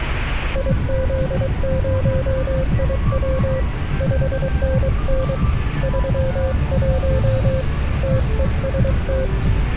Morse code, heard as a keyed tone, hand-sent with a paddle, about 23 wpm, 520 Hz, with street noise. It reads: IZ0IW 5NN 31 TEST